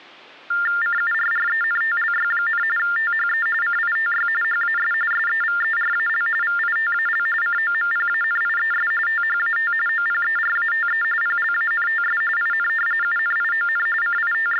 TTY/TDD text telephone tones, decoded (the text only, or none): CURRENTLY, THE CITY HAS SEVERAL VITAL COMPANIES THAT OPERATE PLANTS IN UNION …